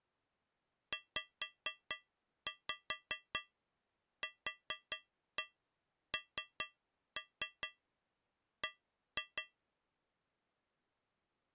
Tap code, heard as taps on a metal pipe, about 4 knocks a second. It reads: ZQNB